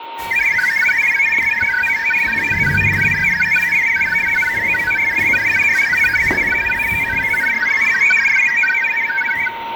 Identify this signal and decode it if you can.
Multi-tone FSK (Olivia or MFSK type), about 1000 Hz wide, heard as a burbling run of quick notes, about 62.5 baud, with a steady whistle near 920 Hz and the noise inside a lift.